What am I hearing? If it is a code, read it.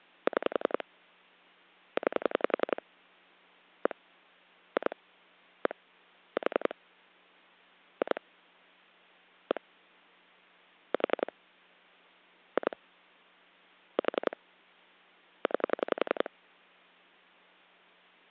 Pulse dialling, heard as clicks on a phone line, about 11 pulses a second. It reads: 6 9 1 2 1 4 2 1 4 2 4 9